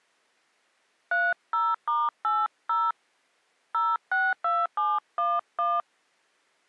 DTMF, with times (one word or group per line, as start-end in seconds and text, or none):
1.1-2.9 30*80
3.7-5.8 062711